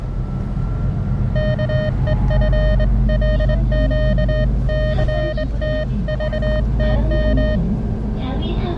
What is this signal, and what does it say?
Morse code (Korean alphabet), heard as a keyed tone, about 21 wpm, 620 Hz, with the noise inside a bus. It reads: 안개처럼